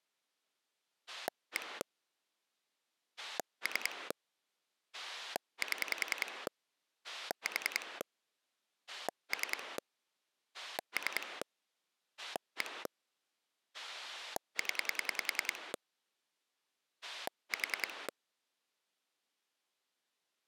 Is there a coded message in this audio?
Yes: pulse dialling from 1.1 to 18.1 s, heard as a rotary dial, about 10 pulses a second. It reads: 1 3 7 4 3 3 1 0 4